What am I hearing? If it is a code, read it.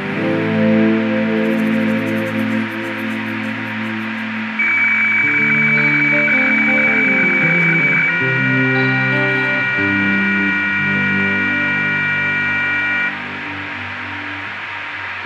Weather fax (radiofax), 120 lines a minute, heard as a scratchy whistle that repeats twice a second, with radio static and room echo.